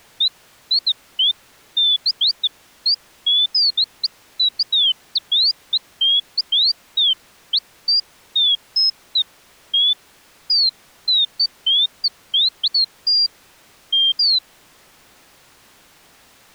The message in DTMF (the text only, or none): none